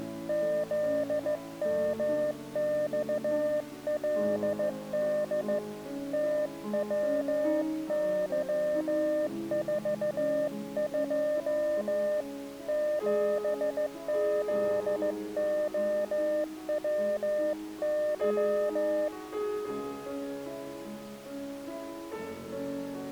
Morse code, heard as a keyed tone, hand-sent with a straight key, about 15 wpm, 600 Hz. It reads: ZMXLD TWY42 7ZOWY